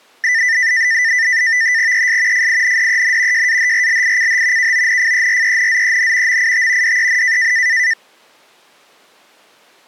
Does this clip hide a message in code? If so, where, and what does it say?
Yes: NAVTEX (SITOR-B), 100 baud, 170 Hz shift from 0.2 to 7.9 s, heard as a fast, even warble, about 1900 Hz centre. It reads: ES FINDEN JAHRLICH KONFERENZEN MIT DEN